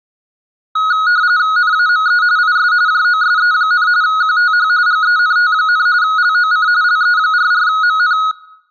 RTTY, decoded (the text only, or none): NAME IS JOSE, QTH GENT, LOC LE44MN